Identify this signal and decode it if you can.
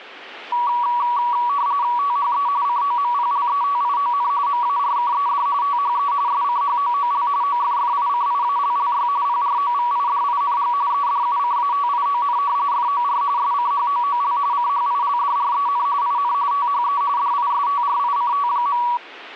RTTY (45.45 baud, 170 Hz shift), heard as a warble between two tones, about 1050 Hz centre. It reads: THE COMPLETION MARKED THE SCHOOL OFFICIALLY PROVIDING EDUCATION FOR SCHOOL CHILDREN IN THE DISTRICT.